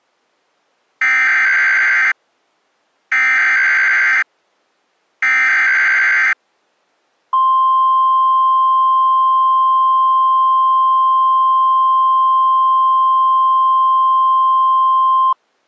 Emergency Alert System (SAME) tones (header bursts, then the 1050 Hz attention tone), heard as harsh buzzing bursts, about 520.83 baud.